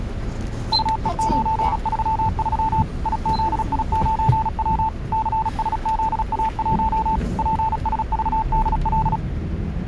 Morse code, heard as a keyed tone, machine-sent, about 36 wpm, 880 Hz, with the noise inside a bus. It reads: UE933 IZI9W CSZA1 PSVDL